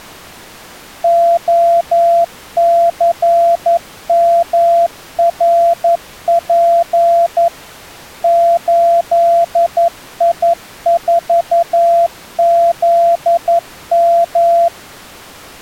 Morse code, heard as a keyed tone, machine-sent, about 11 wpm, 680 Hz. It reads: OCMRP 8I4ZM